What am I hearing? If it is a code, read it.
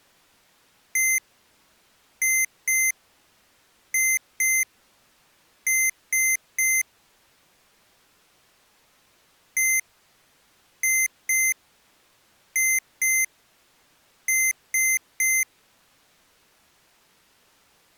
Beep code, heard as beeps from a small speaker, played twice, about 2100 Hz. 1-2-2-3. In Phoenix BIOS tables: BIOS ROM checksum failure.